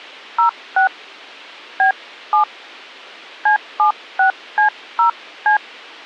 DTMF, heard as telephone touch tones, dialled by hand, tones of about 110 ms. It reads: 06 B7 C76C0C